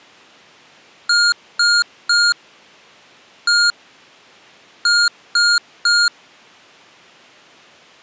Beep code, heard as beeps from a small speaker, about 1420 Hz. 3-1-3. In Phoenix BIOS tables: interrupt mask register failure.